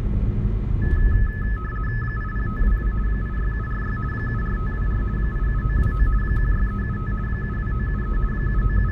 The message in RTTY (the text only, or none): 80522 86746 74524 87929 16375 72973 …